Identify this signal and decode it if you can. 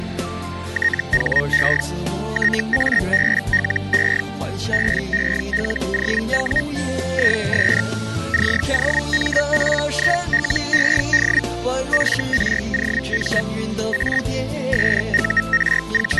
Hellschreiber (Feld-Hell, 122.5 baud), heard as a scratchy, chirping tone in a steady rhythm, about 1850 Hz, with static crashes. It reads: THE TABLE BELOW IS COMPILED FROM A …